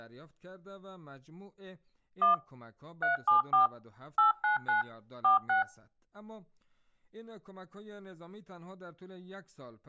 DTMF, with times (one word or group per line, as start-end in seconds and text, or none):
2.2-2.3 1
3.0-3.7 374
4.2-4.8 899
5.2-5.6 46